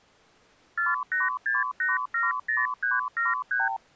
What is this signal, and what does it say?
Multi-frequency trunk signalling (R2, with the far end's replies), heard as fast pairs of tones, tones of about 170 ms. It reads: 486870373